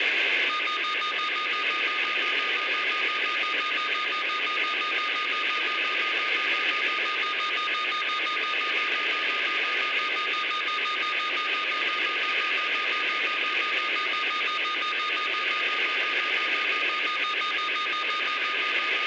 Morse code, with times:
none

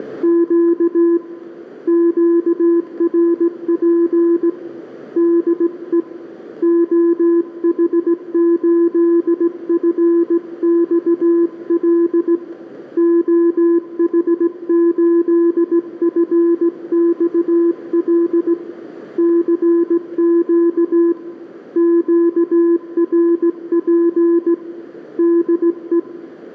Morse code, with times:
0.0-1.2 …
1.9-4.5 QRP
5.2-6.0 DE
6.6-12.3 OH8FXL
13.0-18.5 OH8FXL
19.2-21.1 CQ
21.8-24.5 QRP
25.2-26.0 DE

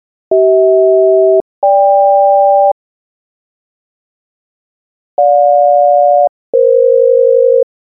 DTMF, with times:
none

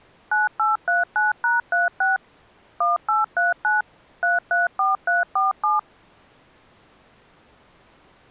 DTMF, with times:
0.3-2.2 9839#36
2.8-3.8 1839
4.2-5.8 334347

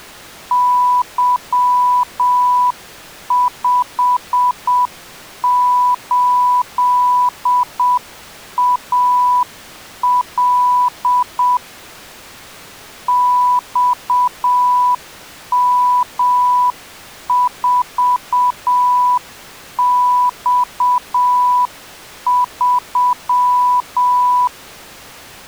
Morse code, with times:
0.5-11.6 Y58AL
13.1-24.5 XM4X3

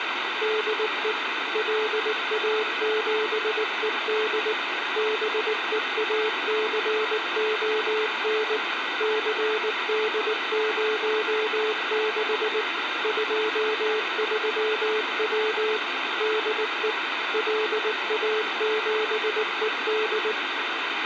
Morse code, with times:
0.4-1.1 DE
1.5-4.5 LA7ED
5.0-8.6 BEACON
9.0-12.6 CD06
13.0-15.8 23W
16.2-16.9 DE
17.3-20.3 LA7ED

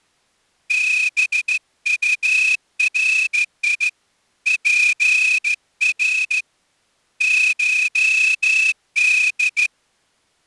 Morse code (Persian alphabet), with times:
0.7-3.9 بطری
4.5-6.4 پر
7.2-9.7 شد

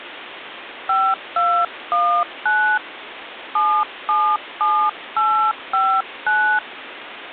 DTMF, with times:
0.9-2.8 5219
3.6-6.6 777859

